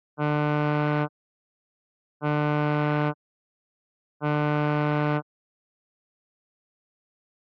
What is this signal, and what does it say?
Ship horn signal, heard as a ship's horn, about 150 Hz. 3 short. At sea: I am operating astern propulsion.